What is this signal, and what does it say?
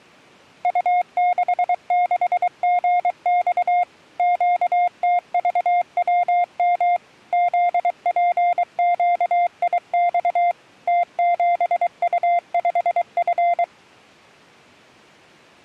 Morse code, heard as a keyed tone, machine-sent, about 23 wpm, 700 Hz. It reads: U66GX QTVWM ZPQIX T7U5F